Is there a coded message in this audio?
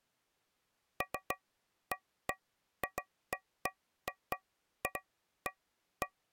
No, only irregular taps on a metal pipe.